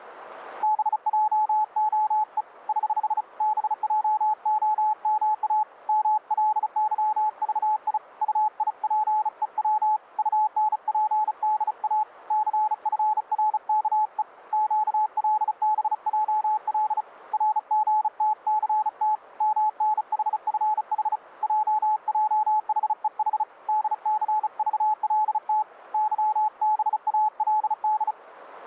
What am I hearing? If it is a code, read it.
Morse code, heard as a keyed tone, hand-sent with a bug key, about 35 wpm, 860 Hz. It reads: BJOE <HH> BJOMA MLYVI UIPEW UNPDA CFRKE QLBJL RGTCT MNHFH JJHEH DCVLT YBALD